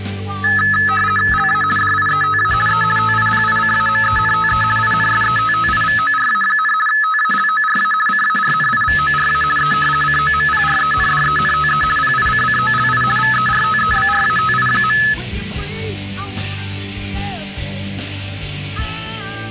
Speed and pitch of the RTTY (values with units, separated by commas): 50 baud, 450 Hz shift, 1500 Hz centre